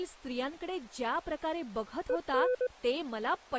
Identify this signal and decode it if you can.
Morse code, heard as a keyed tone, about 20 wpm, 500 Hz, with speech in Marathi. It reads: EN